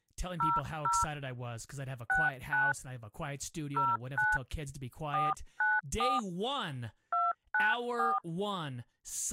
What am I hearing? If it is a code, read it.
DTMF, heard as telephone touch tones, dialled by hand, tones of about 190 ms, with speech in English. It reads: 00 69 09 494 294